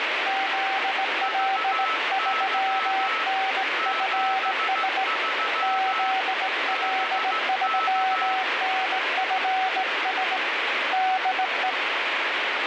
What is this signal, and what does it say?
Morse code, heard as two keyed tones, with heavy radio static. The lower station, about 18 wpm, 760 Hz: ZL3NFS ZL3NFS DE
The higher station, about 15 wpm, 1310 Hz: VY 73 BK